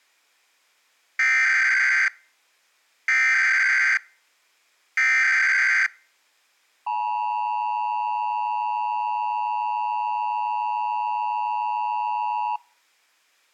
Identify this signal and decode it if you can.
Emergency Alert System (SAME) tones (header bursts, then the 853 and 960 Hz attention tone), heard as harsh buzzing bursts, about 520.83 baud.